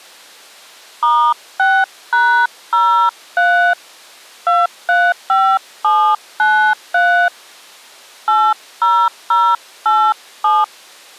DTMF, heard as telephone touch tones, dialled by hand, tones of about 280 ms. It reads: *6#03 235793 80087